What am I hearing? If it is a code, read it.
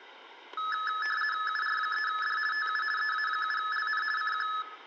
RTTY (50 baud, 450 Hz shift), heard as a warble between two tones, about 1500 Hz centre, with static crashes. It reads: UR3D TU EA7LN CQ